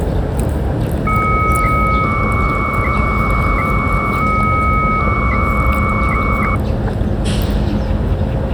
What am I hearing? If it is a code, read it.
300-baud modem data (Bell 103 tones), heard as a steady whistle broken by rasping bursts, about 300 baud, 200 Hz shift, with the noise of a residential street.